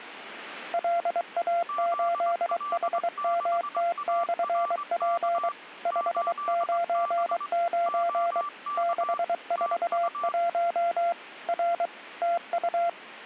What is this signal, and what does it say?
Morse code, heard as two keyed tones. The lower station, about 23 wpm, 690 Hz: LA8HMT/P 599 641 R TU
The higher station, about 21 wpm, 1170 Hz: ZL6ARK 8B OK TU